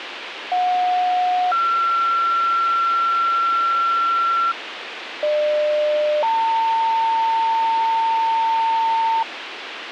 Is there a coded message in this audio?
Yes: two-tone page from 0.5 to 9.2 s, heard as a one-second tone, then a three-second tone, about 730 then 1360 Hz, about 600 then 900 Hz, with radio hiss.